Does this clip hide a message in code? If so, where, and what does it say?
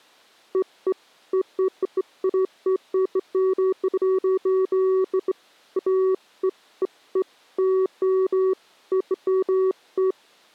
No, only beeps of irregular length.